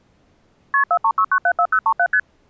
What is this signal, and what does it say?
Multi-frequency trunk signalling (R1, as on North American trunks), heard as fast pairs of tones, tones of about 70 ms. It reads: KP 436974037 ST